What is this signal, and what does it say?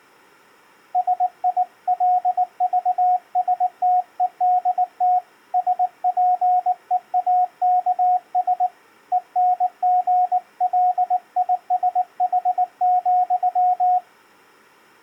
Morse code, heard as a keyed tone, hand-sent with a paddle, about 19 wpm, 730 Hz. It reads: SILVSTEDT SPEAKS ENGLISH,